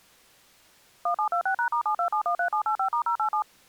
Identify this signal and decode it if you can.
DTMF, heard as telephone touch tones, dialled by machine, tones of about 90 ms. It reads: 1726#*72713785*087